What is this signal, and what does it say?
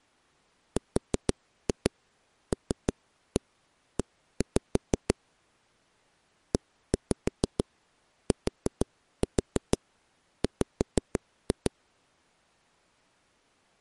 Tap code, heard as knocks on a wall, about 6 knocks a second. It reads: RLE ETW